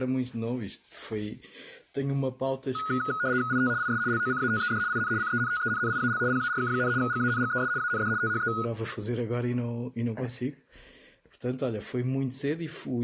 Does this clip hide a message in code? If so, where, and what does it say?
Yes: RTTY (75 baud, 170 Hz shift) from 2.8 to 8.7 s, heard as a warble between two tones, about 1360 Hz centre. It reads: IT IS LOCATED IN CENTENNIAL PARK, GANGES AND THE